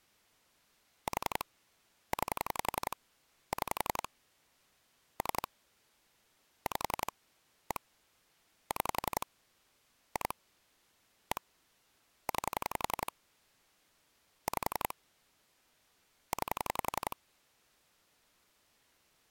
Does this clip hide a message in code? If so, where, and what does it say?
Yes: pulse dialling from 1.1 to 17.1 s, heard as clicks on a phone line, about 11 pulses a second. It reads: 4 9 6 3 5 1 6 2 1 9 5 9